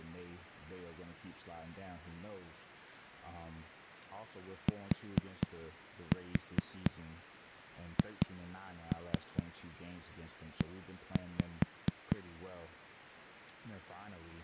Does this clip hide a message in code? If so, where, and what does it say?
Yes: tap code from 4.7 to 12.2 s, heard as knocks on a wall, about 4 knocks a second, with speech in English. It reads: THE